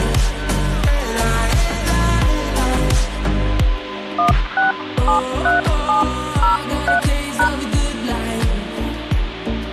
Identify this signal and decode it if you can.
DTMF, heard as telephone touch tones, dialled by hand, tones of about 130 ms. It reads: 1673703#